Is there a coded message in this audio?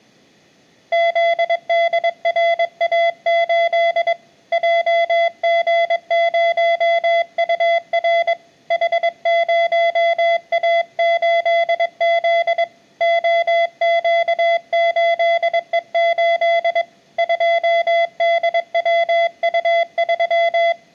Yes: Morse code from 0.9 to 20.8 s, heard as a keyed tone, hand-sent with a paddle, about 22 wpm, 680 Hz. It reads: ZDRA8 JG0UR H0A8Z OQ8E8 2DWU3